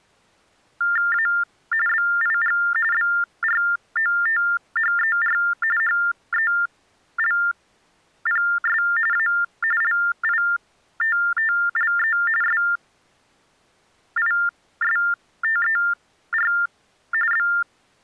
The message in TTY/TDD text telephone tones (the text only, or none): A BIG BROTHER HELPS A LITTLE SISTER …